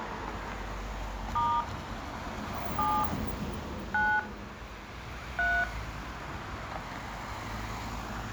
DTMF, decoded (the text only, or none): * 7 9 3